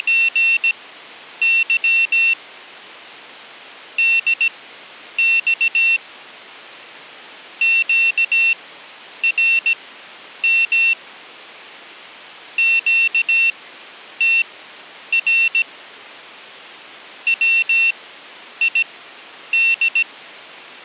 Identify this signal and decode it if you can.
Morse code, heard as a high beeper, machine-sent, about 17 wpm, spaced as for 9 wpm, 2700 Hz. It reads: … DX QRM QTR WID